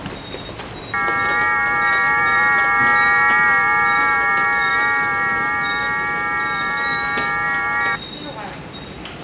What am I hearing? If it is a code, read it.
FT8 (several signals at once), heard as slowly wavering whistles, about 6.25 baud, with the noise of a subway station.